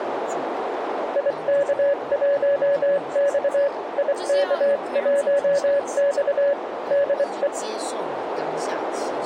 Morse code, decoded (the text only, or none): IK1X IK1X DE